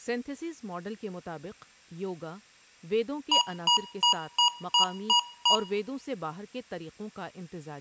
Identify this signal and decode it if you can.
Beep code, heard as beeps from a small speaker, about 960 Hz, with room echo and speech in Urdu. 7 short. In AMI BIOS tables: virtual mode exception error; in Dell tables: processor failure.